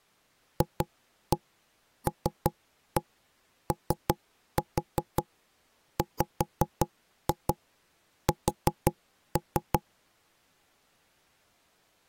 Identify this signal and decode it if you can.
Tap code, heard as knocks on wood, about 5 knocks a second. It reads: FLOWS